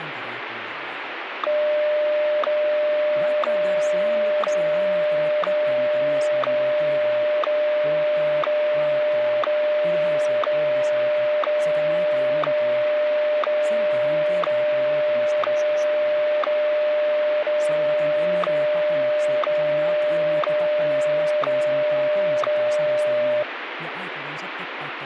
Radio time signal (WWVH, Hawaii), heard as ticks, one a second, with radio static.